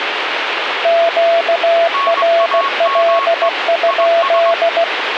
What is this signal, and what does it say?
Morse code, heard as two keyed tones, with radio static. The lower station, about 16 wpm, 670 Hz: QRL?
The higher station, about 21 wpm, 1100 Hz: NAME IS